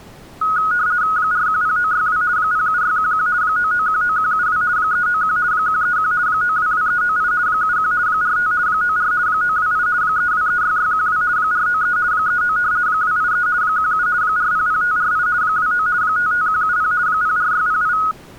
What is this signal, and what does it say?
RTTY (50 baud, 170 Hz shift), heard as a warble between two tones, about 1360 Hz centre. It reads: 410962 07611 9919172 391 131 922398 71 45 94 928 3236612 493 39 283 17 400548 29 55170 04608